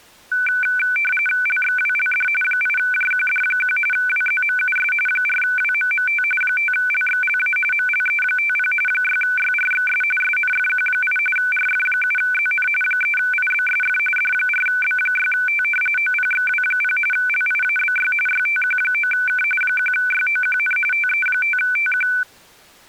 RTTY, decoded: LXWLD 8JQD1 WZMUS 4WMMT 5LXLA MLE50 6YRXS SNFQ8 RF7ZN 3IBSF D4B6T OPXW0 LIABY YTQ9K 1YOQN TE5TQ

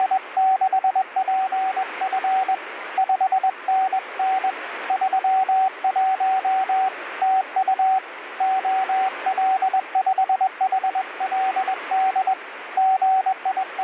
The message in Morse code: … 5NN 31 TU OL5HLD …

